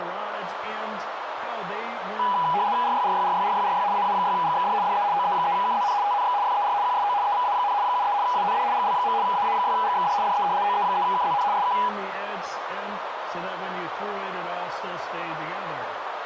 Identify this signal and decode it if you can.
RTTY (75 baud, 170 Hz shift), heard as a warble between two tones, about 900 Hz centre, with radio static and a narrow filter. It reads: RYRYRYRYRY AA6GXD DE OE3KZN TNX FER QSO EVA, 73 AND GL. AA6GXD DE OE3KZN SK